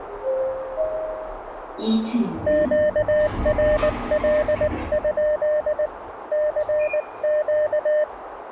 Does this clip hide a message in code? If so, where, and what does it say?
Yes: Morse code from 2.4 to 8.1 s, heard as a keyed tone, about 19 wpm, 600 Hz, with radio static, a narrow filter and the noise inside a lift. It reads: QRL? CQ